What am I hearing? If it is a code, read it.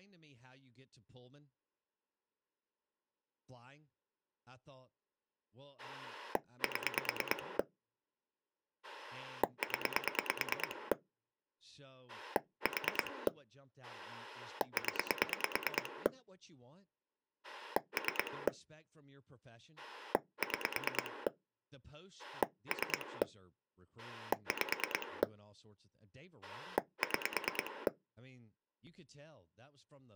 Pulse dialling, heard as a rotary dial, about 9 pulses a second, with speech in English. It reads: 7 0 4 0 3 6 3 5 6